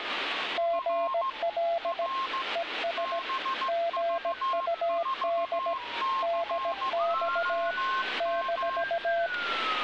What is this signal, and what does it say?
Morse code, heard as two keyed tones, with radio static and street noise. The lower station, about 17 wpm, 680 Hz: GL ES GUD DX -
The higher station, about 15 wpm, 1070 Hz: R R BV4COM